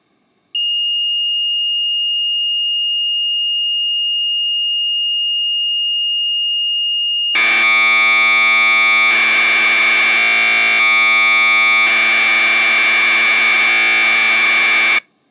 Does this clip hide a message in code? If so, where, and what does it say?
Yes: Commodore tape loading (standard loader) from 0.5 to 15.0 s, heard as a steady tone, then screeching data.